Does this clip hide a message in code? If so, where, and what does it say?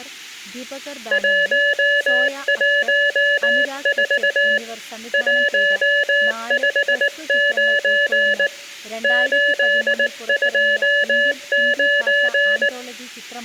Yes: Morse code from 1.1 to 12.7 s, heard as a keyed tone, hand-sent with a paddle, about 19 wpm, 580 Hz, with room echo and speech in Malayalam. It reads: 114 159 829